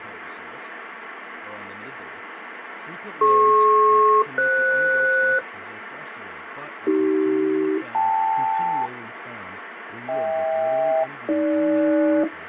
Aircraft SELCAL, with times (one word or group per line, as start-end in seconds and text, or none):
3.2-5.4 DP-FS
6.9-8.9 AC-KL
10.1-12.2 HK-AG